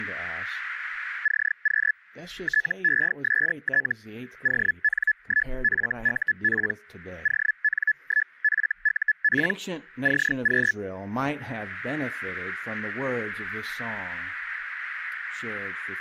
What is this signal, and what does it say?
Hellschreiber (Feld-Hell, 122.5 baud), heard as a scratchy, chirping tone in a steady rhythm, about 1700 Hz. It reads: CQ TEST ON1FUP ON1FUP CQ